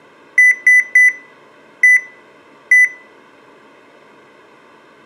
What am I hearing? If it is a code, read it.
Beep code, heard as beeps from a small speaker, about 2000 Hz, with room echo. 3-1-1. In Phoenix BIOS tables: DMA register failure.